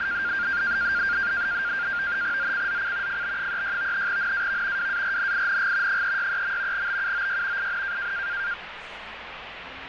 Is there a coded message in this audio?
Yes: NAVTEX (SITOR-B), 100 baud, 170 Hz shift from 0.0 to 8.5 s, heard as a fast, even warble, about 1500 Hz centre, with radio static and street noise. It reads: ZCZC FB36 NAV WARNING 363. BUOY IN